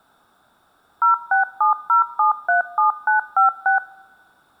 DTMF, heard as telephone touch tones, dialled by machine, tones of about 120 ms. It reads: 0670737956